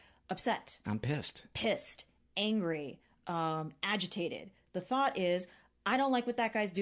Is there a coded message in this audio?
No, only speech in English.